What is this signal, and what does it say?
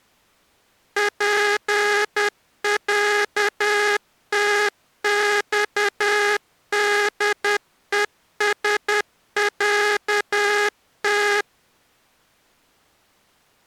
Morse code (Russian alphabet), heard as a buzzer, machine-sent, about 10 wpm. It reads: ПЯТЬДЕСЯТ